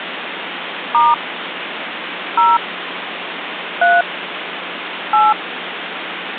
DTMF, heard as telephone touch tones, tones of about 200 ms, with phone line noise. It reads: * 0 3 8